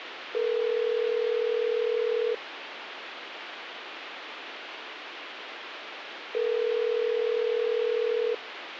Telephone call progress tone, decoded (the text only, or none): ringback tone